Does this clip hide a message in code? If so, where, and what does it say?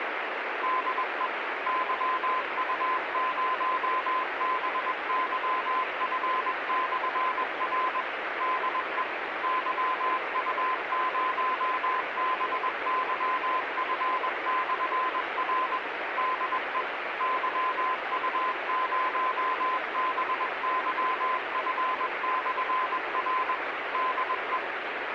Yes: Morse code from 0.6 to 24.6 s, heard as a keyed tone, machine-sent, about 21 wpm, 1030 Hz, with radio static. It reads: DE YU0BYF/R DE YU0BYF/R DE YU0BYF/R DE